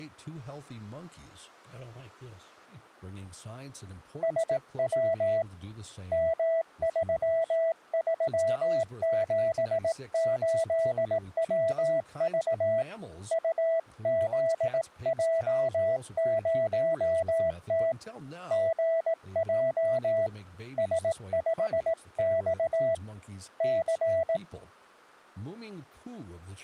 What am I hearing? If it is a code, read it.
Morse code, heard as a keyed tone, hand-sent with a paddle, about 18 wpm, 660 Hz, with speech in English. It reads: SW M3378WV UZJ0T GJ S5X C